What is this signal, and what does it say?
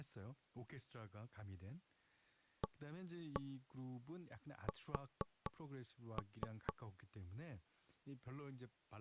Tap code, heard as knocks on wood, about 4 knocks a second, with speech in Korean. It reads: AS